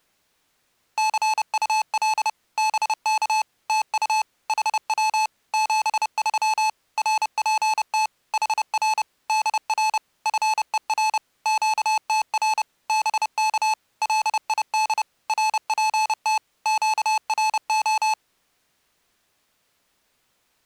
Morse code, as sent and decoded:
-.-. ..- .-.. / -... -.- / - ..- / .... .-- / --... ...-- / .-. .--. - / .... .-. / -.. .-. / ..-. . .-. / --.- - .-. / -... -.- / .-.. .. -.. / .-. .--. - / --.- .-. ---
CUL BK TU HW 73 RPT HR DR FER QTR BK LID RPT QRO

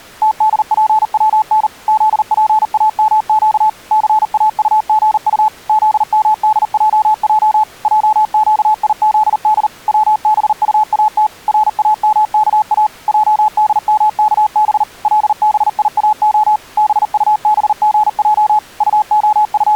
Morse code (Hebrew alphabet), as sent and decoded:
- -.. .--. .-- -. / --.. .--. .- -- --.- / -.-. .- ..- --. ..- / --.. -- -.. .--- .--- / .--- --.- .. --.. -.. / .-- -... ..- .- - / .-. .- -- -.- .- / .--- -.. -- -.- -... / .-.. -... .. .- --- / -... ..- -... --. .--- / …
תדפצן זפאמק סאטגט זמדעע עקיזד צבטאת ראמכא עדמכב לביאה בטבגע …

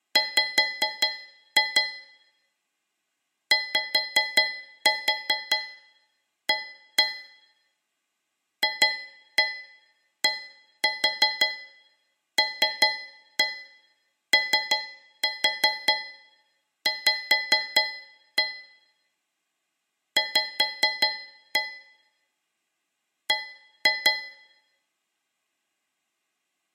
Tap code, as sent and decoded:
5-2 / 5-4 1-1 / 2-1 1-4 3-1 3-4 5-1 / 5-1 / 1-2
W YA FDLOV V B

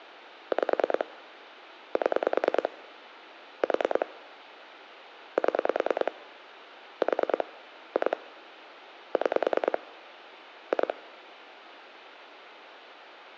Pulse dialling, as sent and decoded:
5 / 7 / 4 / 7 / 4 / 2 / 6 / 2
5 7 4 7 4 2 6 2

